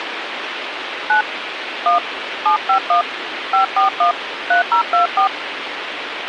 DTMF, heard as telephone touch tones, dialled by hand, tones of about 110 ms, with radio hiss and a squelch burst at the end. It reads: 9 1 751 541 3024